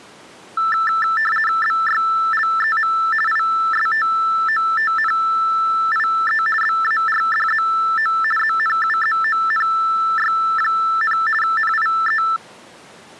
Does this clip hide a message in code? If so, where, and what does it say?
Yes: RTTY (50 baud, 450 Hz shift) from 0.6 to 12.4 s, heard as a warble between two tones, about 1550 Hz centre. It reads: BYLEM ISTOTNIE BARDZO ZNUZONY, NIE